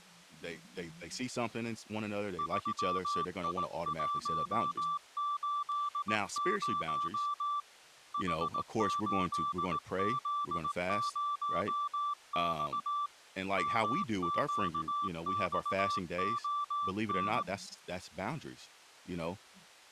Morse code, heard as a keyed tone, hand-sent with a paddle, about 18 wpm, 1170 Hz, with speech in English. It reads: 3I180 H8Z0X MQXON